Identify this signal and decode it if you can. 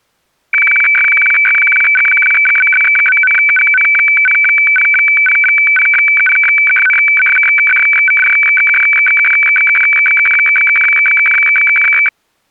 Weather fax (radiofax), 120 lines a minute, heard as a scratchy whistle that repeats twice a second.